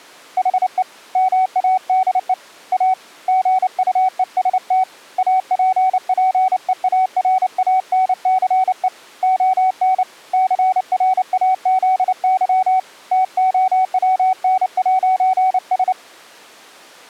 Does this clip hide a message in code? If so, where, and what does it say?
Yes: Morse code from 0.3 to 16.0 s, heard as a keyed tone, hand-sent with a paddle, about 29 wpm, 750 Hz. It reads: HE MADE A GUEST APPEARANCE ON CRAZY TOWN'S